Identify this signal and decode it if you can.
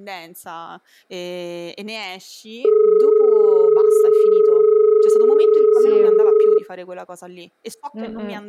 Telephone call progress tone (as in Australia), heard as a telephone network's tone, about 430 Hz, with speech in Italian. Dial tone.